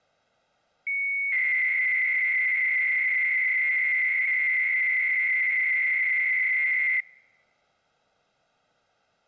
300-baud modem data (Bell 103 tones), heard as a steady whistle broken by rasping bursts, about 300 baud, 200 Hz shift.